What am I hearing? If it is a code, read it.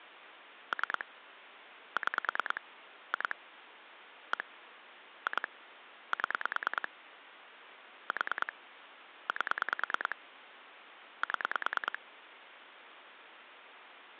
Pulse dialling, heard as clicks on a phone line, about 9 pulses a second, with phone line noise. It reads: 3 6 2 1 2 7 4 8 7